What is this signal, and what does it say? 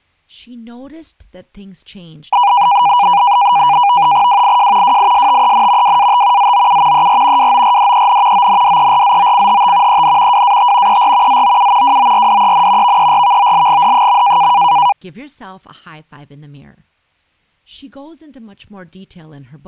NAVTEX (SITOR-B), 100 baud, 170 Hz shift, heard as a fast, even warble, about 890 Hz centre, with speech in English. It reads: WIJ WISTEN WAT ZOU ER WORDEN ONDERZOCHT EN WAT ER ZOU WORDEN VERVOLGD.